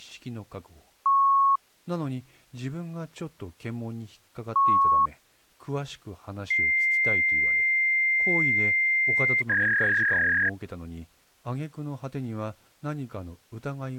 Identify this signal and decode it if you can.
Fax machine handshake, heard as beeps, a long tone and a warble, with speech in Japanese.